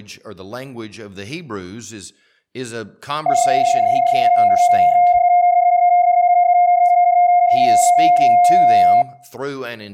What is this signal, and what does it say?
PSK31 (31.25 baud), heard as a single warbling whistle, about 710 Hz.